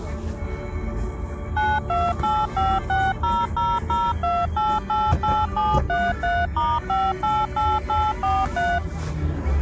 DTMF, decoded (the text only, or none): 928560002888733*588843